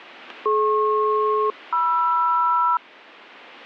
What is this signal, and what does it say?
Aircraft SELCAL, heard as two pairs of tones, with radio static. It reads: DP-MR